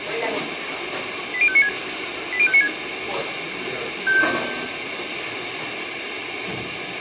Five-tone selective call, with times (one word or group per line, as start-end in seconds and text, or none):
1.3-1.7 80596
2.3-2.7 80596